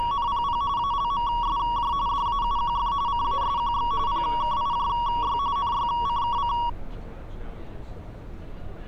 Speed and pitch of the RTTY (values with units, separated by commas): 45.45 baud, 170 Hz shift, 1030 Hz centre